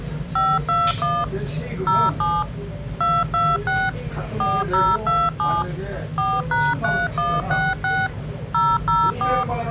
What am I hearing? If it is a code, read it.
DTMF, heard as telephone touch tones, dialled by machine, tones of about 220 ms, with the noise of a restaurant. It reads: 521 07 226 4027 4#3166 004